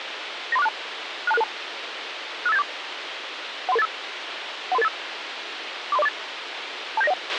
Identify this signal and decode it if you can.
Five-tone selective call (EIA), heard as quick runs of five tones, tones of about 30 ms, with radio hiss and a squelch burst at the end. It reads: 93462 62662 65874 13385 13385 43048 27901